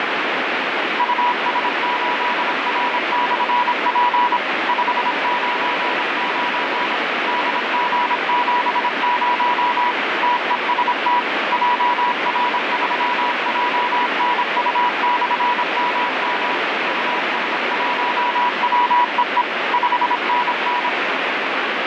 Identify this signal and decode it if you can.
Morse code, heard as a keyed tone, machine-sent, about 26 wpm, 980 Hz, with heavy radio static. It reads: US8R/P 599 DG70 TEST JR3JNU/MM US1WEE 5NN